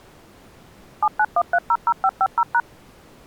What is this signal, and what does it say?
DTMF, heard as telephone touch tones, dialled by machine, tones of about 60 ms. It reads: 791300550#